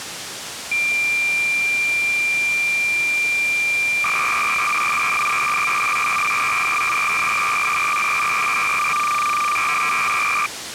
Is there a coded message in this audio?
Yes: cassette data (Kansas City type), 300 baud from 0.7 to 10.5 s, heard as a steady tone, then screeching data, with tape hiss.